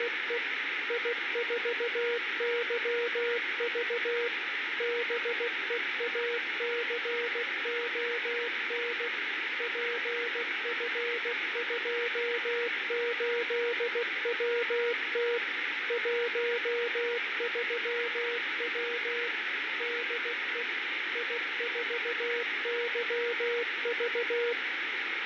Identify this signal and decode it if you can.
Morse code, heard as a keyed tone, machine-sent, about 16 wpm, 480 Hz, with heavy radio static and fading. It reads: … I4YV BEACON PF28WT 13W DE I4YV